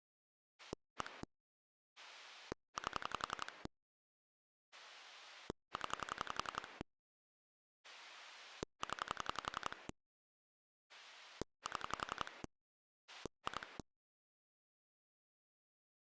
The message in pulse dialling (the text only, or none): 1 8 0 0 7 2